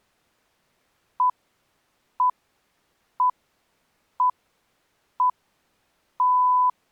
Radio time signal (six pips, as the Greenwich Time Signal), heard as pips.